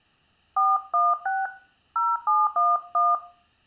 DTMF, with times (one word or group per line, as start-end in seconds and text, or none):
0.6-1.5 416
2.0-3.1 0711